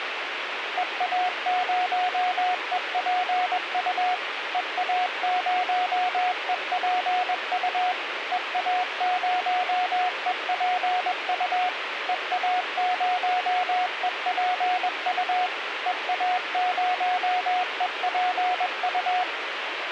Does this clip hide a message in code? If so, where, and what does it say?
Yes: Morse code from 0.7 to 19.3 s, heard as a keyed tone, machine-sent, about 21 wpm, 730 Hz, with radio hiss. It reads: EA0EPU EA0EPU EA0EPU EA0EPU EA0EPU